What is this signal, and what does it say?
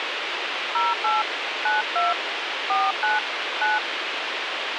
DTMF, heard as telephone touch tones, dialled by hand, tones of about 200 ms, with radio hiss. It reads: 08 92 49 9